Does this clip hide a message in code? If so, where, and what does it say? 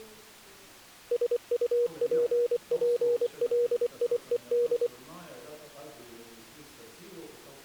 Yes: Morse code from 1.1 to 4.9 s, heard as a keyed tone, machine-sent, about 24 wpm, 480 Hz. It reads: SUPPLIED